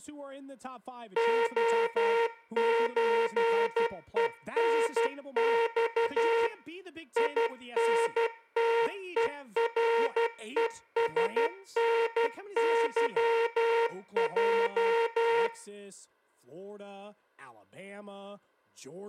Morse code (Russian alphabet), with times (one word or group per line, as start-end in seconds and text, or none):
1.2-6.5 ОЧЕНЬ
7.2-15.5 ИНТЕРЕСНЫЙ